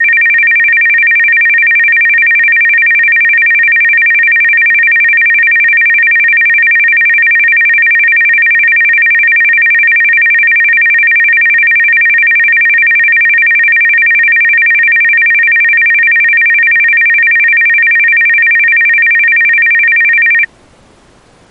A tone that alternates evenly between two pitches. There is no code.